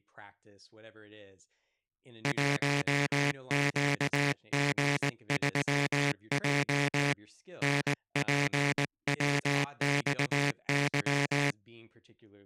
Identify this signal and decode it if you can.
Morse code, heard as a buzzer, hand-sent with a paddle, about 19 wpm, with speech in English. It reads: 1QG3J NPWXY